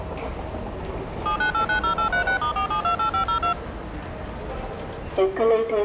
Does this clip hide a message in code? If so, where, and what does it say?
Yes: DTMF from 1.3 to 3.5 s, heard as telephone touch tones, dialled by machine, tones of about 100 ms, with the noise of a subway station. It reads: 79890836*4728502